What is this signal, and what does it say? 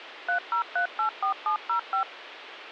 DTMF, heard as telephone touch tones, dialled by machine, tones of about 100 ms, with phone line noise. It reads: 30384705